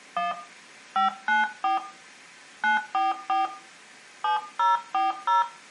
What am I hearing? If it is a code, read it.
DTMF, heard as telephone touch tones, dialled by hand, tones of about 150 ms, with room echo. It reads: 1 594 944 7040